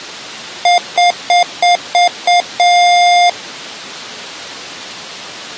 Beep code, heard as beeps from a small speaker, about 710 Hz. 6 short, 1 long.